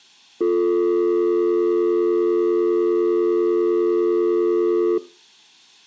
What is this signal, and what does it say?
Telephone call progress tone (North American or UK plan), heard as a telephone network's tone, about 350, 440 Hz. Dial tone.